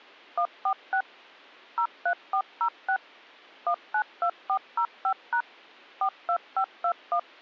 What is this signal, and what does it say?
DTMF, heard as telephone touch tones, dialled by machine, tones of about 80 ms. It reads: 146 03406 192405# 42521